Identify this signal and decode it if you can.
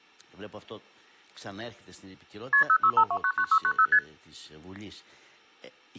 Multi-frequency trunk signalling (R1, as on North American trunks), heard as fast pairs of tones, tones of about 70 ms. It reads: KP 065299690 ST